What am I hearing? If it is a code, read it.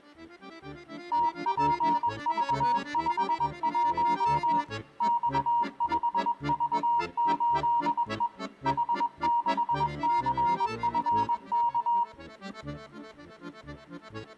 Morse code, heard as a keyed tone, machine-sent, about 21 wpm, 940 Hz. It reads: TPV51 X5V8E H6CFK